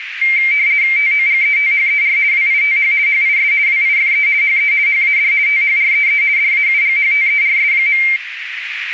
RTTY (50 baud, 170 Hz shift), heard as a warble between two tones, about 2200 Hz centre, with radio static and a narrow filter. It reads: TOGETHER WITH HIS WIFE HE HAD THREE DAUGHTERS.